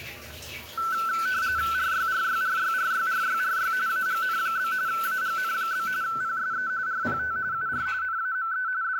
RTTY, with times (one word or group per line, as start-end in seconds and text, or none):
1.7-3.7 RYRYRYRYRYRY
3.9-4.7 AGN?
4.9-5.9 AGN?
6.0-6.7 PSE
6.9-7.4 RPT
7.5-7.9 UR
8.0-8.7 NAME
8.8-9.0 …